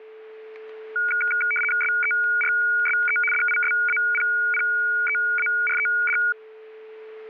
RTTY (75 baud, 850 Hz shift), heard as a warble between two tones, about 1850 Hz centre, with static crashes and a steady whistle near 440 Hz. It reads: SERSE DISAPPEARED